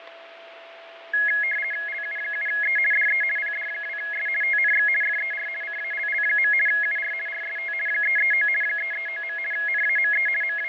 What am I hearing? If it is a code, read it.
RTTY (50 baud, 450 Hz shift), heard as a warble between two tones, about 1900 Hz centre, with radio static, fading and a steady whistle near 670 Hz. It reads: LU7E DE PD2S TNX FER CALL. UR RST 339 339. NAME …